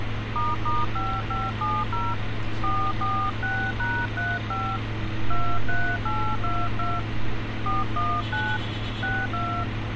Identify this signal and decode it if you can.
DTMF, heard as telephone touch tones, dialled by hand, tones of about 240 ms, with radio hiss and street noise. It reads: **5570 446#35 23822 419 62